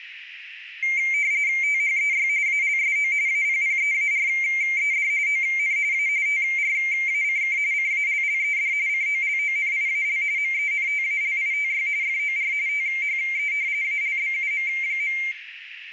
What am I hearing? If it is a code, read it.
RTTY (45.45 baud, 170 Hz shift), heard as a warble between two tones, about 2200 Hz centre, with radio static and room echo. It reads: THEY ALSO APPEARED ON A TRACK CALLED COLONIAL MENTALITY FOR THE ALBUM.